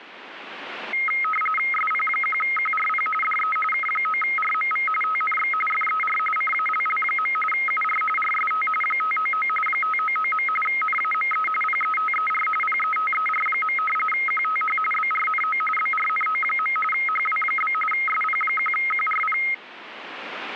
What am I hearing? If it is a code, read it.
RTTY (45.45 baud, 850 Hz shift), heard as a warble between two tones, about 1700 Hz centre. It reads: SP1QRP DE K9RMV TNX FER CALL. UR RST 599 599. NAME PETER PETER. QTH BRNO BRNO. HW? SP1QRP